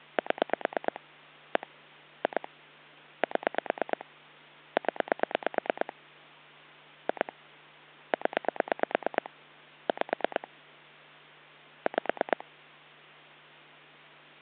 Pulse dialling, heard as clicks on a phone line, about 9 pulses a second, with hum. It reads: 7 1 2 7 0 2 0 5 5